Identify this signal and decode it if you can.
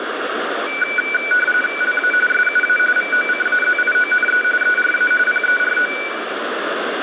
RTTY (45.45 baud, 850 Hz shift), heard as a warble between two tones, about 1900 Hz centre, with radio static. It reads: LA SUA VOCAZIONE ERA PERO